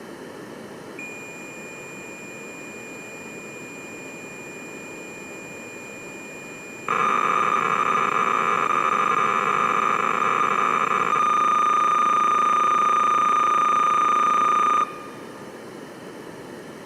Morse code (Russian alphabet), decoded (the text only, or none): none